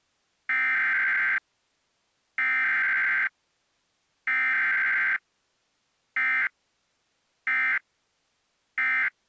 Emergency Alert System (SAME) tones (header bursts, then end-of-message bursts), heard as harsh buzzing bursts, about 520.83 baud.